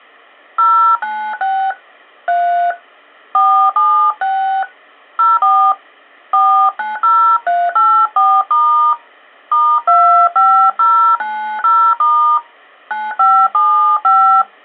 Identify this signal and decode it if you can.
DTMF, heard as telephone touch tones, dialled by hand, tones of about 300 ms. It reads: 096 3 476 04 490384* *25090* 9575